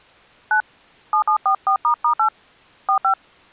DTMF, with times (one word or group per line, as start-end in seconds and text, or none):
0.5-0.6 9
1.1-2.3 7744**8
2.9-3.1 45